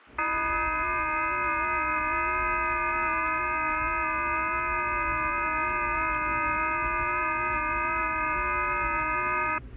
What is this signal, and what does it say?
FT8 (several signals at once), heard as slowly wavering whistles, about 6.25 baud, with static crashes and the noise inside a car.